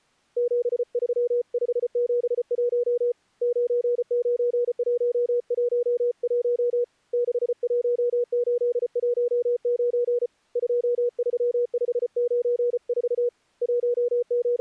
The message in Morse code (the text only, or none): 73571 99111 61819 23594 …